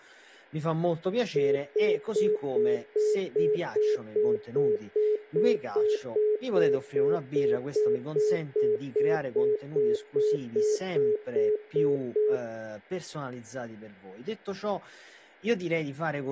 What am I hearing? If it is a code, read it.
Telephone call progress tone (single-tone plan, as in most of Europe), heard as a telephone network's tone, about 420 Hz, 0.2 s on and 0.2 s off, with speech in Italian. Congestion tone.